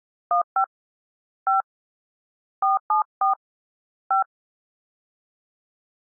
DTMF, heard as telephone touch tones, dialled by hand, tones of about 130 ms. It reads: 15 5 474 5